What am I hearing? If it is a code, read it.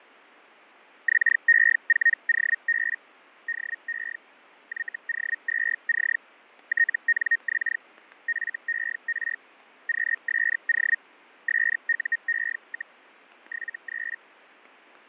Hellschreiber (Feld-Hell, 122.5 baud), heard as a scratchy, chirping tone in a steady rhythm, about 1850 Hz, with fading and static crashes. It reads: XE4OB DE YO2C TNX FER QSO SUE, 73